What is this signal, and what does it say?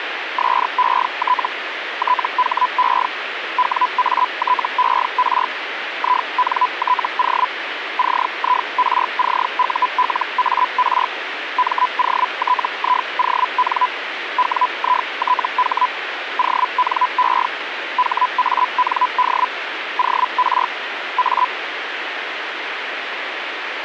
Hellschreiber (Feld-Hell, 122.5 baud), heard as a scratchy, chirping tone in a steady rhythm, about 1000 Hz, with radio static. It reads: SET THE WATER INTO CIRCULAR MOTION WITH ONE HAND OR A